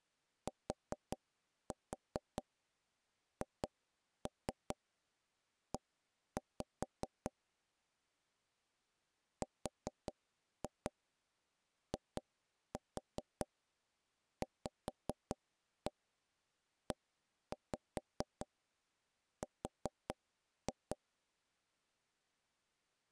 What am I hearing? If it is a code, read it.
Tap code, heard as taps on a table, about 4 knocks a second. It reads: THE RIVER